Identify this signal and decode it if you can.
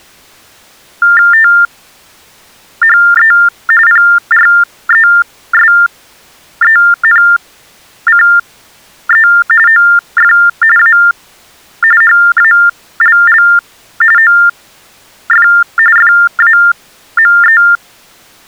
TTY/TDD text telephone tones (45.45 baud Baudot), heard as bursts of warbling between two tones, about 400 Hz shift, 1600 Hz centre. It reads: THE PRESENCE OF A HALL OF FAME